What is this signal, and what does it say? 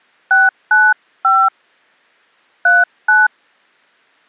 DTMF, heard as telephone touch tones, dialled by hand, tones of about 200 ms. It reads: 695 39